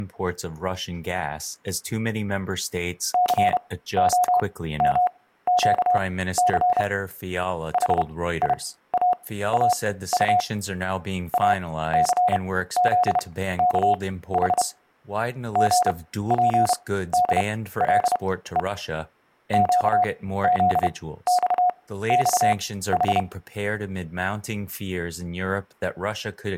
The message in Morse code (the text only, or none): COMQC HIAAU ACZKH GPDLE QZXXH